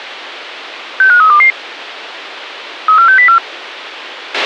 Five-tone selective call (CCIR), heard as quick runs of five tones, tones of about 100 ms, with a squelch burst at the end. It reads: 65322 34604